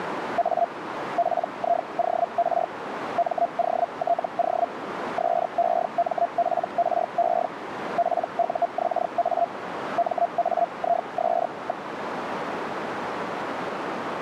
Hellschreiber (Feld-Hell, 122.5 baud), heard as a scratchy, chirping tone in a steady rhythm, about 690 Hz, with radio static and a narrow filter. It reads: A PIOR MOTO SEMPRE PUXA MAIS.